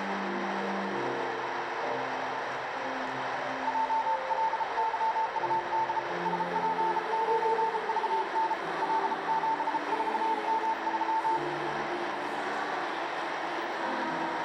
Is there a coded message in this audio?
Yes: Morse code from 3.6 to 11.4 s, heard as a keyed tone, hand-sent with a bug key, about 33 wpm, 890 Hz, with radio static. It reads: JLYUD SP9VN L74M3